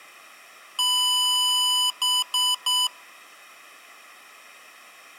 Beep code, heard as beeps from a small speaker, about 1000 Hz, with room echo. 1 long, 3 short. In Award and IBM BIOS tables: video adapter failure; in AMI BIOS tables: memory failure.